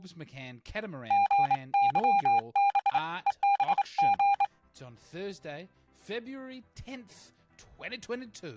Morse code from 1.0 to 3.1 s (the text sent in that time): GYB